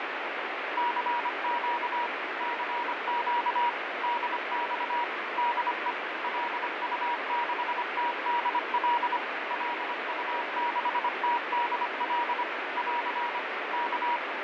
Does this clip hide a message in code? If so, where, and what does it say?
Yes: Morse code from 0.7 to 14.2 s, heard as a keyed tone, machine-sent, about 25 wpm, 960 Hz, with heavy radio static and fading. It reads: CQ CQ DX DE LU6TDL LU6TDL <AR> K